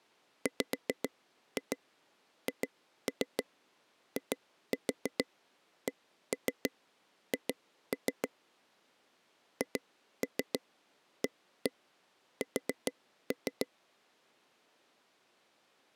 Tap code, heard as taps on a table, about 6 knocks a second. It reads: WHICH HAS